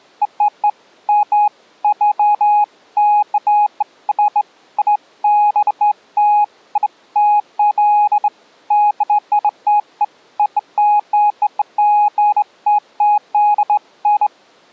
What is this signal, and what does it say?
Beeps of irregular length. There is no code.